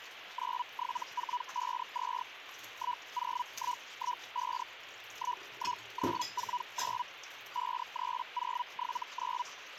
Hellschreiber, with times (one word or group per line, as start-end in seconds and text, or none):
0.3-2.2 97452
2.7-4.6 10115
5.1-7.0 11949
7.5-9.4 53079